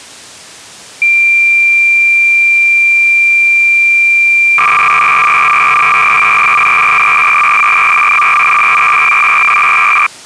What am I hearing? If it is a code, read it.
Cassette data (Kansas City type), 300 baud, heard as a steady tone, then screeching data.